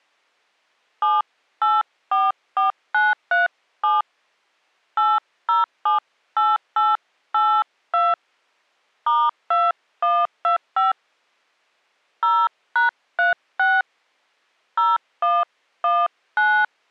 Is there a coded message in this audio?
Yes: DTMF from 1.0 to 16.6 s, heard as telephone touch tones, dialled by hand, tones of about 200 ms. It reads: 7844937 8078882 *2125 0#36 0119